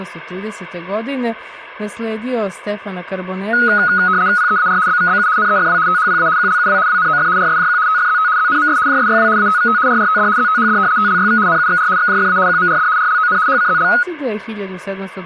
RTTY (75 baud, 170 Hz shift), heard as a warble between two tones, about 1360 Hz centre. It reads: PEAR BVBU NEFW THPA QLUW WNOF RSJQ TFZT ZNMS JSYW ATVT RRTD ZTHD TLYV NUXR XJFA QMRD RLON HCZL